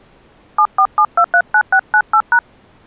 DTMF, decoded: 747239698#

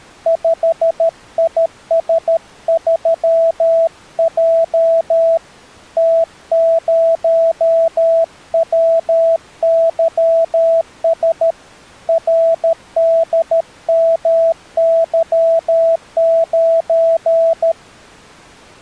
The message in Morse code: 5IS3J T0WYS RDMY9

